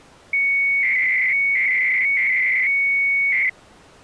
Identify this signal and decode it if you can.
300-baud modem data (Bell 103 tones), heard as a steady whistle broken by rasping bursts, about 300 baud, 200 Hz shift.